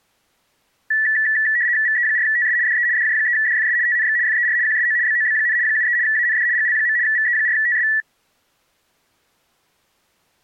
RTTY (75 baud, 170 Hz shift), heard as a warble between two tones, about 1850 Hz centre. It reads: VE4TS DE DJ3DFS TNX FER QSO BOB, 73 AND GL. VE4TS